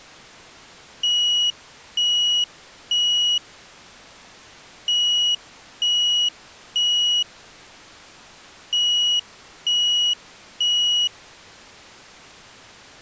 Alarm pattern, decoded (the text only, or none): temporal three